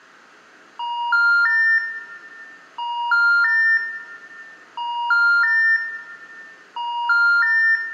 Telephone call progress tone (ITU plan), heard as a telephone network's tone, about 950, 1400, 1800 Hz, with room echo. Special information tone.